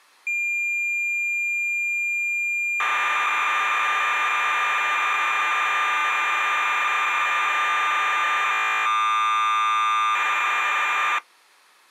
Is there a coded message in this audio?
Yes: cassette data (Kansas City type), 1200 baud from 0.3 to 11.2 s, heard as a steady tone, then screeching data.